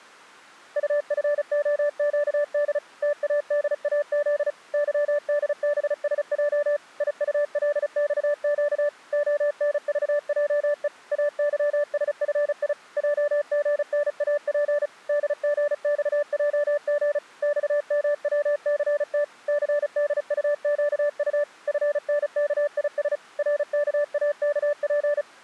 Morse code, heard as a keyed tone, machine-sent, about 35 wpm, 590 Hz. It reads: UFOQD TADAZ YDBSJ IULXQ ONVJE AYSFI JGNAP DGXJG XMWCT CDUQU FNKIS RKAKP